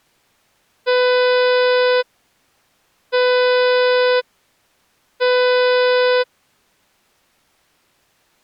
Ship horn signal, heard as a ship's horn, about 500 Hz. 3 short. At sea: I am operating astern propulsion.